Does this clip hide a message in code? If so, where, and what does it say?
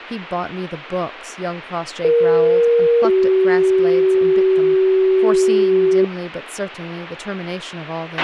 Yes: two-tone page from 2.0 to 6.0 s, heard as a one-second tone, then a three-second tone, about 470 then 380 Hz, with a squelch burst at the end and speech in English.